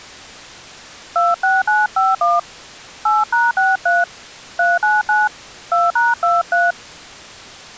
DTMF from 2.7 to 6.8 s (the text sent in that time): 8#63 399 2#23